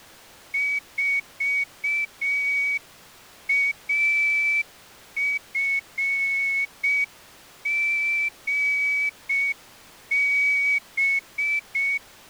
Morse code, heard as a whistle, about 6 wpm. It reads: 4AFGB